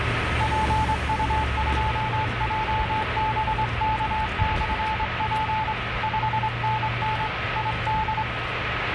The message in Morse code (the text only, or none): PU2JBK/P 5NN ID